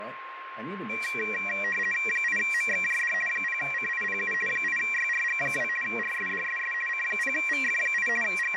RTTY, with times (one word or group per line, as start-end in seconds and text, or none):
2.1-3.1 8MXJD
3.3-4.3 0CIPU
4.5-5.7 8YRG2
5.8-6.7 RSDSS
6.9-8.1 C0VF8
8.2-8.6 …